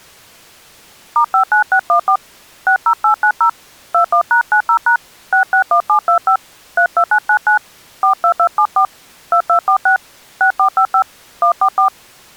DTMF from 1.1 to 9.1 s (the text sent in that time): *59614 60890 21#90# 661725 32999 42274